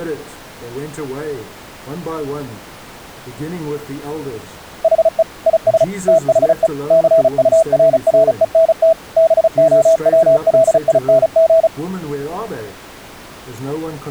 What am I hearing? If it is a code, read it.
Morse code, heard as a keyed tone, machine-sent, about 35 wpm, 650 Hz. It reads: HE IS THE CURRENT BOWLING